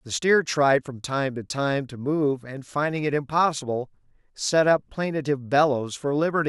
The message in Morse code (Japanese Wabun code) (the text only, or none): none